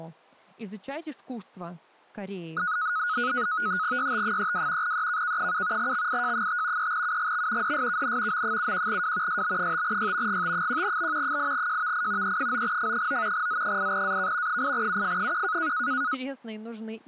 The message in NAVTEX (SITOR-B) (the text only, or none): YT32 EKK7 XIJ5 3UGX DSKN M71W SB5Y GT1B 8JVI E9F9 Z8AK 8UF1